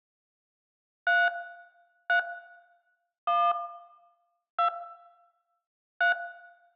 DTMF, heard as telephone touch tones, dialled by hand, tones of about 170 ms, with room echo. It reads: 3 3 1 2 3